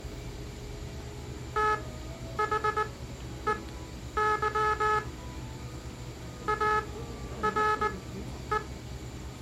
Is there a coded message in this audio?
Yes: Morse code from 1.5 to 8.6 s, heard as a buzzer, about 19 wpm, spaced as for 10 wpm, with the noise of a cafe. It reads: THEY ARE